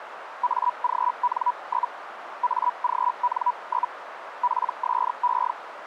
Hellschreiber (Feld-Hell, 122.5 baud), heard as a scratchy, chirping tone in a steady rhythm, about 980 Hz, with radio static and a narrow filter. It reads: AGN? AGN? PSE